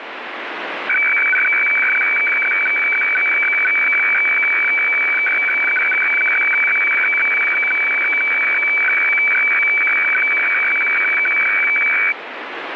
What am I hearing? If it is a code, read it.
Weather fax (radiofax), 120 lines a minute, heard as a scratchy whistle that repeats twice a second, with radio static.